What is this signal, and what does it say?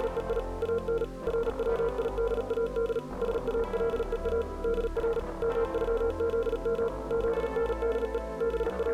Morse code (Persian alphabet), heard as a keyed tone, machine-sent, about 37 wpm, 460 Hz. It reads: … ان رویداد سالها در مغزم زنده …